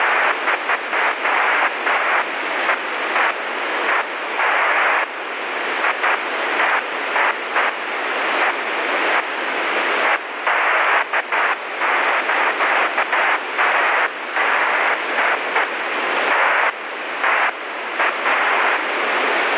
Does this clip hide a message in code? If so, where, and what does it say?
No, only bursts of noise, with heavy radio static.